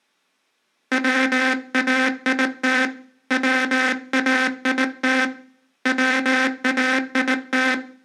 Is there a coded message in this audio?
Yes: Morse code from 0.9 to 7.8 s, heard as a buzzer, hand-sent with a paddle, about 19 wpm, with room echo. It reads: WAIT WAIT WAIT